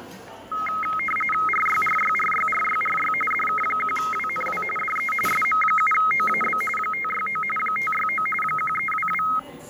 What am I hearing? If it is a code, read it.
RTTY (45.45 baud, 850 Hz shift), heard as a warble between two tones, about 1700 Hz centre, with static crashes and the noise of a cafe. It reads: RYRYRYRYRY DK1WNW DE SM7OAB 569 569 1322